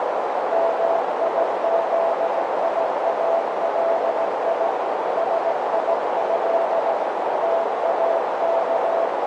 Morse code (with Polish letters), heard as a keyed tone, machine-sent, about 17 wpm, 670 Hz, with heavy radio static and a narrow filter. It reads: MIZIALI SIĘ TAK